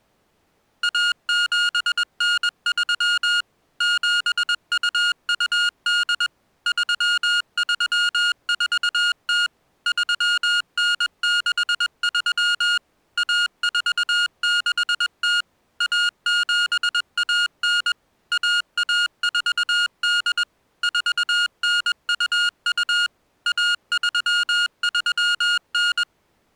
Morse code (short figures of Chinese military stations), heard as electronic beeps, machine-sent, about 21 wpm, 1430 Hz. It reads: 1793 7228 3340 3963 1460 1719 1148 4922 1339